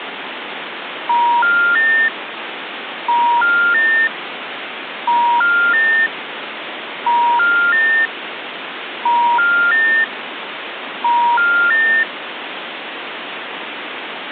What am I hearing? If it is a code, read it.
Telephone call progress tone (ITU plan), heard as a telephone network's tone, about 950, 1400, 1800 Hz, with phone line noise. Special information tone.